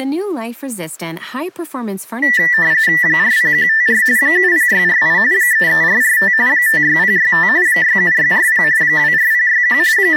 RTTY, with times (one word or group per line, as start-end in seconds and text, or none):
3.0-4.0 40154
4.2-5.2 70648
5.3-6.3 33445
6.5-7.5 56065
7.7-8.6 67640
8.8-9.8 24061
10.0-10.2 …